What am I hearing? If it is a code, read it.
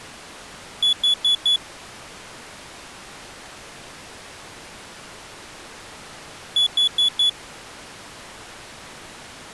Alarm pattern, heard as an alarm's beeps, played twice, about 3400 Hz. Temporal four. Carbon monoxide.